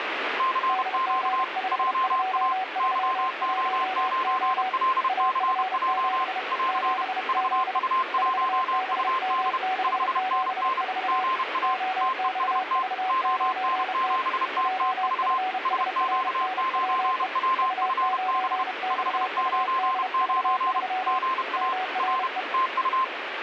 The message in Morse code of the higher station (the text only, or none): CQ JA YO9LCJ <AR> VU1UD 5NN GA TEST ON7TTV SQ9WFB 599 GA R TU